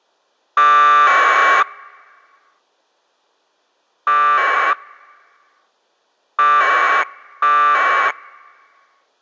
Packet radio (AX.25, as in APRS), 1200 baud, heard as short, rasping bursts.